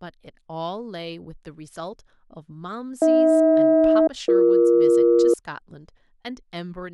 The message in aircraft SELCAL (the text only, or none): AH-BE